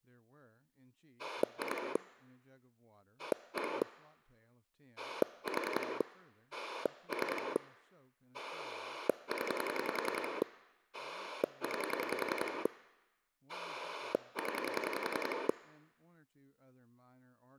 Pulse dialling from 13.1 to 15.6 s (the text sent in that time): 0